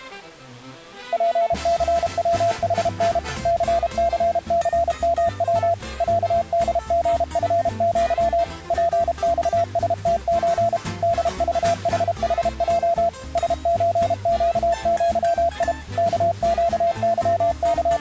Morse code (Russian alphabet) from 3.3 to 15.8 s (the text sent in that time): ЦЦЦМВ ЯДГФЪ ПЬСТЧ ДЖХХЙ СЧЩЪИ